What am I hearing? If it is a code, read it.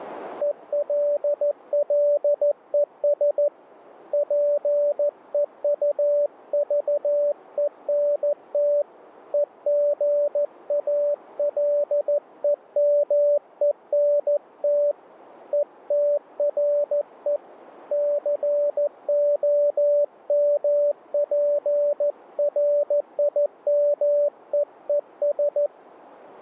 Morse code, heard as a keyed tone, hand-sent with a paddle, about 14 wpm, 580 Hz. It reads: ELLES PEUVENT EGALEMENT ETRE COMPRIMEES